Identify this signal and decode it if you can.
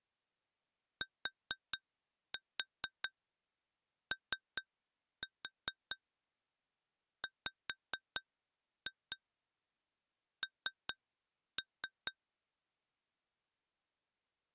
Tap code, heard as taps on glass, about 4 knocks a second. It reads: TOWN